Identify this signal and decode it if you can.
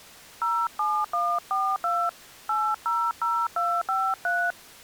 DTMF, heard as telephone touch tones, dialled by hand, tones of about 250 ms. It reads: 07142 800253